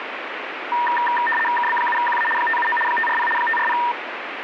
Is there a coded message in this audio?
Yes: RTTY (75 baud, 850 Hz shift) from 0.7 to 3.9 s, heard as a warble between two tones, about 1390 Hz centre, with radio static. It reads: KB7QA 579 540 540